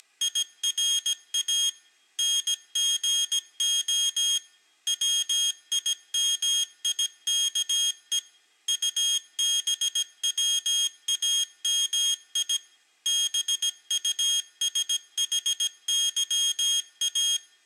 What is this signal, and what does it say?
Morse code, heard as a high beeper, machine-sent, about 17 wpm, 3250 Hz. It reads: … NGO WIMIKE UBWAMI BUSHYA